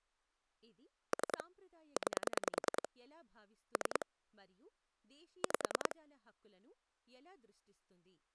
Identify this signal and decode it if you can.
Pulse dialling, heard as clicks on a phone line, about 10 pulses a second, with speech in Telugu. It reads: 3 9 3 5